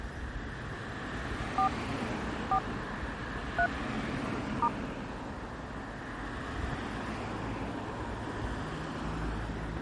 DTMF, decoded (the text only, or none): 4 4 3 *